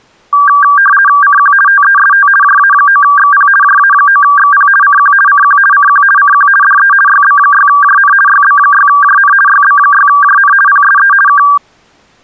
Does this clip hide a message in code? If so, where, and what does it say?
Yes: RTTY (50 baud, 450 Hz shift) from 0.3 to 11.6 s, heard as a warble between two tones, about 1370 Hz centre. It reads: CQ TEST JA9XP JA9XP CQ CQ CQ CQ DE YB6JN YB6JN YB6JN PSE K